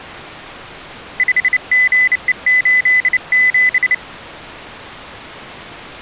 Morse code, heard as a high beeper, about 29 wpm, 2000 Hz. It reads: 5GE87